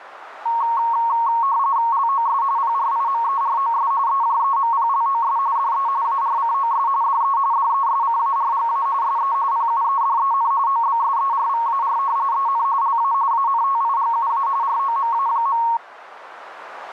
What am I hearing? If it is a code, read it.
RTTY (45.45 baud, 170 Hz shift), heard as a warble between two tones, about 1010 Hz centre, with radio static and a narrow filter. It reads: LOS PRIMEROS EJEMPLOS DE ARCOS DE DESCARGA SE PUEDEN OBSERVAR EN LA ANTIGUA ROMA.